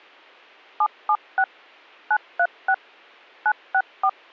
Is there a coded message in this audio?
Yes: DTMF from 0.8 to 4.1 s, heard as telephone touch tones, dialled by machine, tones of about 60 ms. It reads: 776 936 964